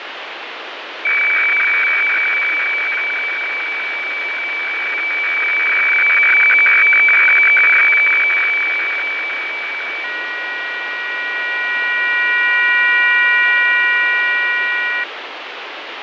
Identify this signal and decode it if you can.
Weather fax (radiofax), 120 lines a minute, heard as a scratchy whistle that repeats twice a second, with radio static and fading.